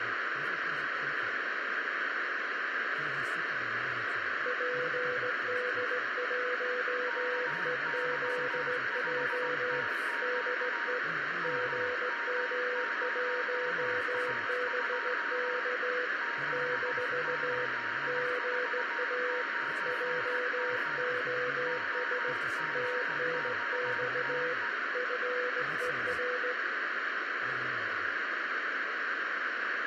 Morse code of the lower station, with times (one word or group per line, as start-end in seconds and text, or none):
4.5-9.8 PD1EZJ
10.2-11.0 DE
11.4-16.1 GM1BK
16.5-17.7 -
18.1-19.4 GA
19.9-22.3 JOS
22.7-24.5 TNX
24.9-26.5 FER